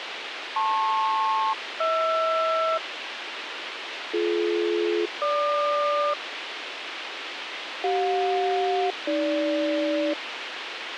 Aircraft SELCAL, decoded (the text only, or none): LP-HR BD-GQ CJ-AG